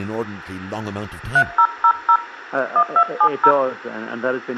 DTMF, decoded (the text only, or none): 3000 1270